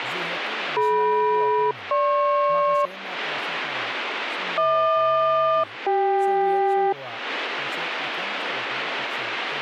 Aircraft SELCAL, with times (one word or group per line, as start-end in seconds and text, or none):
0.8-2.9 DM-GP
4.6-6.9 HQ-CK